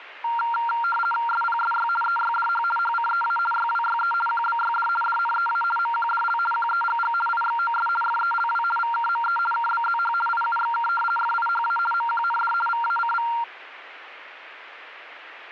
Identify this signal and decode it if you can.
RTTY (50 baud, 450 Hz shift), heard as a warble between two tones, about 1160 Hz centre. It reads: SPSY EYDH HCEA YWYE QBYD DNEA MQDL QEGG IXOS FELW VKME KBZH IUXK FIHA MQND VACV